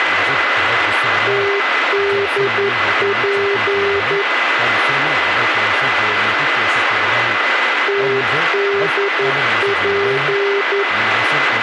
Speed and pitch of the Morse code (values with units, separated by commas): 11 wpm, 400 Hz